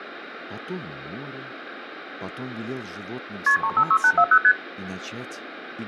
Multi-frequency trunk signalling (R1, as on North American trunks), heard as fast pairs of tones, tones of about 70 ms, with phone line noise. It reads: KP 356840 ST